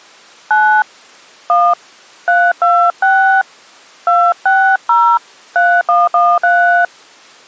DTMF, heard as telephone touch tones, dialled by hand, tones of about 290 ms. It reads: 9 1 326 260 3113